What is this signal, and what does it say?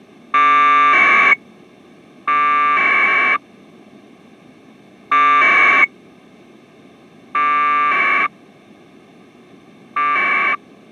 Packet radio (AX.25, as in APRS), 1200 baud, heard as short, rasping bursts.